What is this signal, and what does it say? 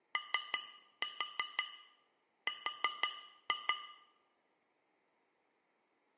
Tap code, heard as taps on glass, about 5 knocks a second, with room echo. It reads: OR